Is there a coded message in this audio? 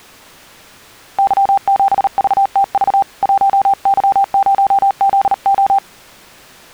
Yes: Morse code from 1.1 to 5.8 s, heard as a keyed tone, hand-sent with a paddle, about 38 wpm, 790 Hz. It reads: Y7VTV 1Y0ZO